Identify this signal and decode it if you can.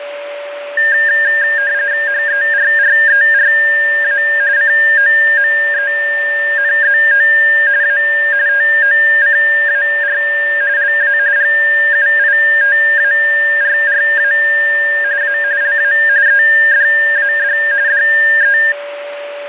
RTTY (45.45 baud, 170 Hz shift), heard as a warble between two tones, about 1700 Hz centre, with radio static and a steady whistle near 580 Hz. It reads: HERRERA COMENZO A TOCAR LA GUITARRA A LA EDAD DE